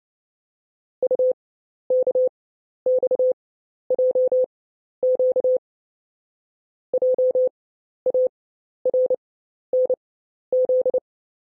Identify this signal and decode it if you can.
Morse code, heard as a keyed tone, machine-sent, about 29 wpm, spaced as for 12 wpm, 510 Hz. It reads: UKXJQ JARNZ